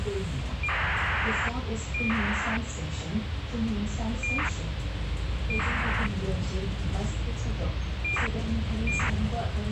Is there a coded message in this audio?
Yes: ACARS aircraft data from 0.6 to 9.1 s, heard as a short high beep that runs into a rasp, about 2400 baud, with radio hiss and the noise inside a bus.